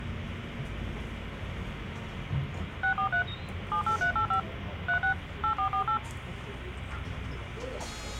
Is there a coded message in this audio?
Yes: DTMF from 2.8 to 6.0 s, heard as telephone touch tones, dialled by machine, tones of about 100 ms, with the noise inside a bus. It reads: 643 78385 36 8448